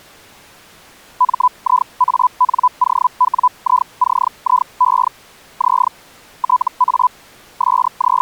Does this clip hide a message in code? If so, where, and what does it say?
Yes: Hellschreiber (Feld-Hell, 122.5 baud) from 1.2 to 8.2 s, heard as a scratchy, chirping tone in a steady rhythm, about 1000 Hz. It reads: MIANOWICIE Z TA …